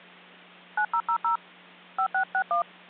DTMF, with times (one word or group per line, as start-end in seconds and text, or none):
0.8-1.4 9000
2.0-2.6 5661